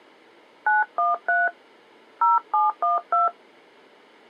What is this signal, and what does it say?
DTMF, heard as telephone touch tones, dialled by hand, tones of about 160 ms. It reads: 913 0712